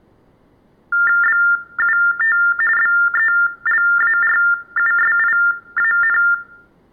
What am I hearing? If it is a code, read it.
TTY/TDD text telephone tones (45.45 baud Baudot), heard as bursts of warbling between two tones, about 400 Hz shift, 1600 Hz centre, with room echo. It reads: BUT BELARUSIAN